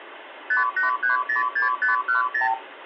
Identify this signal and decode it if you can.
Multi-frequency trunk signalling (R2, with the far end's replies), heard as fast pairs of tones, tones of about 130 ms, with phone line noise. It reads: 58306510